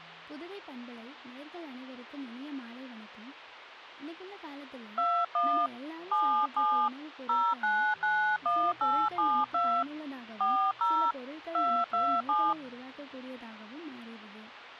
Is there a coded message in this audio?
Yes: DTMF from 5.0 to 12.5 s, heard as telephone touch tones, dialled by hand, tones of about 290 ms. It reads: 21 77 0991872 40 227